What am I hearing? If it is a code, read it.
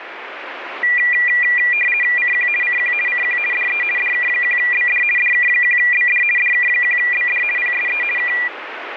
RTTY (50 baud, 450 Hz shift), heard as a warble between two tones, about 2200 Hz centre, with radio static. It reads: CQ CQ CQ DE DK1BD DK1BD DK1BD PSE K